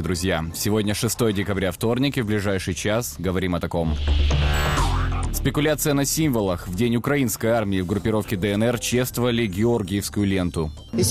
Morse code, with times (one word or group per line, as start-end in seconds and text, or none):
none